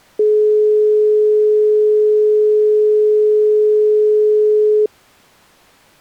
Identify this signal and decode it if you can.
Telephone call progress tone (425 Hz plan, as in most of Europe), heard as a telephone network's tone, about 420 Hz. Dial tone.